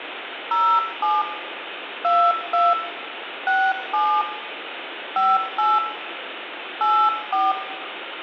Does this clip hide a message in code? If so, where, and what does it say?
Yes: DTMF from 0.5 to 7.5 s, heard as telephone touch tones, dialled by hand, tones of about 230 ms, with phone line noise and room echo. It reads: 07 22 67 58 84